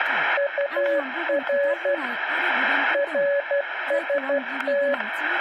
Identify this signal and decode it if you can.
Morse code, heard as a keyed tone, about 12 wpm, 560 Hz, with static crashes and speech in Bodo. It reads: UR RST